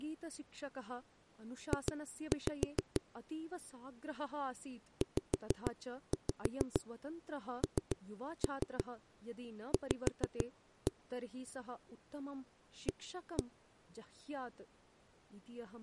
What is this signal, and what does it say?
Tap code, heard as knocks on a wall, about 6 knocks a second, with speech in Sanskrit. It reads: J ZNV A